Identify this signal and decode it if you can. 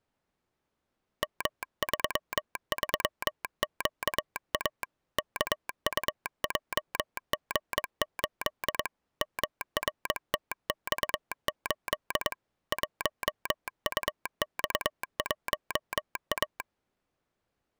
Morse code, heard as a telegraph sounder, hand-sent with a paddle, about 22 wpm. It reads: M33QA KUJG8 MRTX8 1UX1A